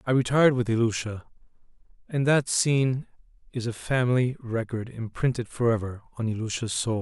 Speech in English. There is no code.